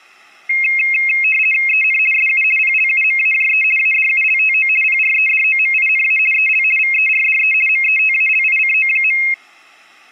RTTY (50 baud, 450 Hz shift), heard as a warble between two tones, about 2350 Hz centre. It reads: EN SU PLUMAJE ADULTO PREDOMINA EL VERDE METALICO.